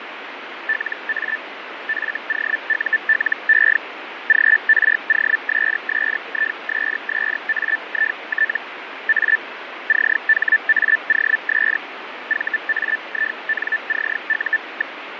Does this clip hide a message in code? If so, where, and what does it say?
Yes: Hellschreiber (Feld-Hell, 122.5 baud) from 0.7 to 15.0 s, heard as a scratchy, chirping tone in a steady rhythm, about 1750 Hz, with radio static and fading. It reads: LA FOULE GROSSISSAIT A CHAOS VAINCU.